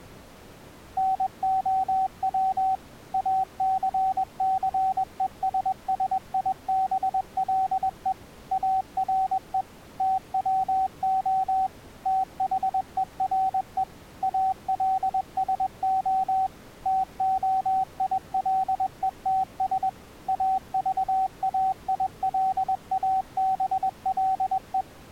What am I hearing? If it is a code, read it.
Morse code, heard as a keyed tone, machine-sent, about 21 wpm, 760 Hz. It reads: NOW ACCESSIBLE ARE TWO THERE ALSO TOILETS AVAILABLE